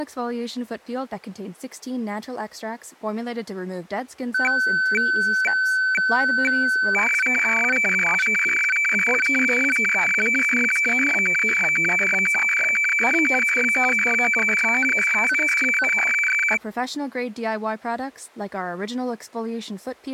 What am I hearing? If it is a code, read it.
Weather fax (radiofax), 120 lines a minute, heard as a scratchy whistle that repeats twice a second, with speech in English.